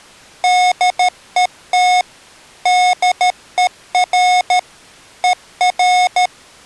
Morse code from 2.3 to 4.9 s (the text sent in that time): DER